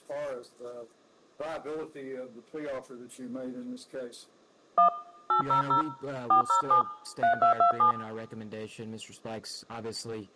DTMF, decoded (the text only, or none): 1 800 407 3227